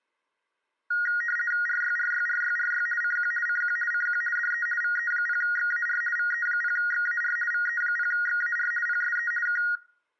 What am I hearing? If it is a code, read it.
RTTY (50 baud, 450 Hz shift), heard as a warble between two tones, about 1650 Hz centre. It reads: RYRYRYRY CQ CQ CQ DE VE0XAR VE0XAR VE0XAR PSE K